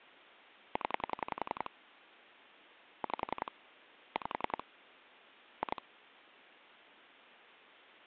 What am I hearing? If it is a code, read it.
Pulse dialling, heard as clicks on a phone line, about 11 pulses a second, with phone line noise. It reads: 0 5 5 2